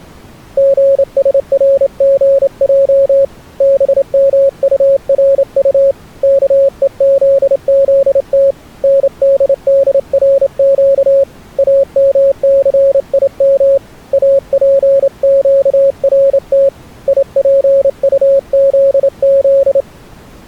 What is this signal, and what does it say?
Morse code (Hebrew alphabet), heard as a keyed tone, hand-sent with a straight key, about 28 wpm, 550 Hz. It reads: גשרגע במטרט כוזזת נדדרק אמסים אפקרת יפטזז